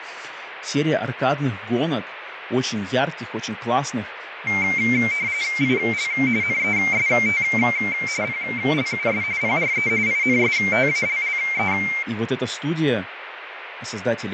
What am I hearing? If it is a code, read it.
RTTY (45.45 baud, 170 Hz shift), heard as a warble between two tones, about 2200 Hz centre, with radio static, fading and speech in Russian. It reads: IL NEST PLUS PRE INSTALLE